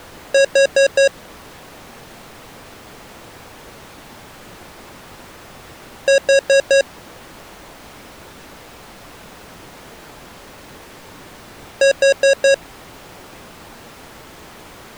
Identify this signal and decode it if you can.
Alarm pattern, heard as an alarm's beeps, played three times, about 550 Hz. Temporal four. Carbon monoxide.